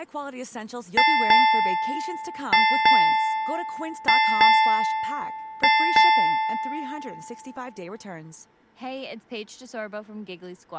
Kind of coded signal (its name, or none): ship's bell